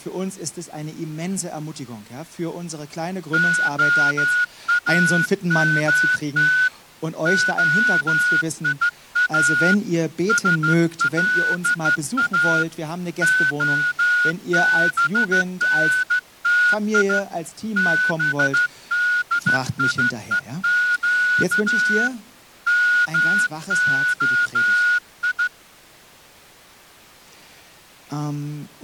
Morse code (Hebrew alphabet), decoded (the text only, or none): האמת היא שלא הבנתי בדיוק מהי